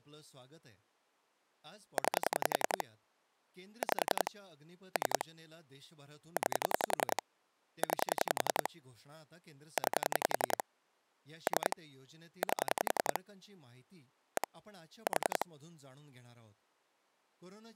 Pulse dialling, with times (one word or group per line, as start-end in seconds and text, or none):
2.0-2.8 9
3.8-4.3 5
5.0-5.2 3
6.4-7.2 9
7.8-8.7 9
9.8-10.6 9
11.5-11.8 3
12.4-13.2 8
14.4-14.5 1
15.1-15.4 4